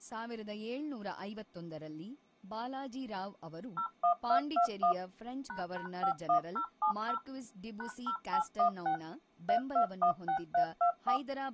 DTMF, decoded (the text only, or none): 01221 ##51070 #0816 3216324